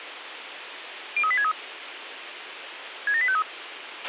Five-tone selective call (ZVEI), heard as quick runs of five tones, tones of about 70 ms, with radio hiss and a squelch burst at the end. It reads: 03863 67853